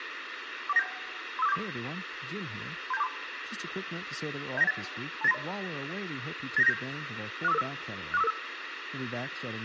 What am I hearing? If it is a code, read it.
Five-tone selective call (EIA), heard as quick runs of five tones, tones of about 30 ms, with radio hiss, room echo and speech in English. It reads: 41971 35474 37243 07918 28930 89797 64555 64555